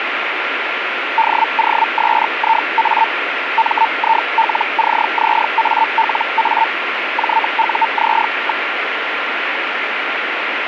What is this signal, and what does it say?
Hellschreiber (Feld-Hell, 122.5 baud), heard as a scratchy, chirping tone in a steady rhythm, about 900 Hz, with radio static. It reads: DOSIA MILCZALA JUZ.